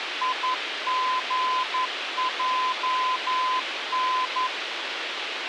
Morse code, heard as a keyed tone, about 11 wpm, 1020 Hz, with radio hiss and a squelch burst at the end. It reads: IGJN